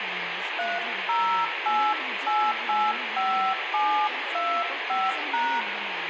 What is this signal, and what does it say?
DTMF, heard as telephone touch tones, dialled by hand, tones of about 280 ms, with radio hiss, room echo and speech in Kannada. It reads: 308885725#